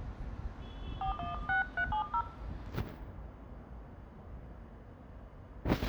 DTMF, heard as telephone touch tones, dialled by hand, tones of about 120 ms, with room echo and street noise. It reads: 416370